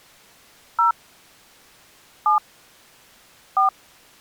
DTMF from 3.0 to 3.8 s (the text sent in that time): 4